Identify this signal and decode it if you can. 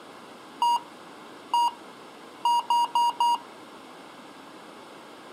Beep code, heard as beeps from a small speaker, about 950 Hz. 1-1-4. In Phoenix BIOS tables: BIOS ROM checksum failure.